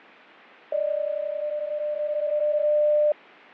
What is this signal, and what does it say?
PSK31 (31.25 baud), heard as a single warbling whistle, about 600 Hz, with fading.